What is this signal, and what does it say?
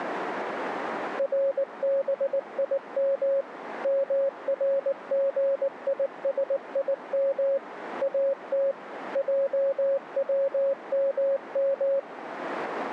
Morse code (Hebrew alphabet), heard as a keyed tone, machine-sent, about 19 wpm, 550 Hz, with radio static. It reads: רבים מרגישים את עצמם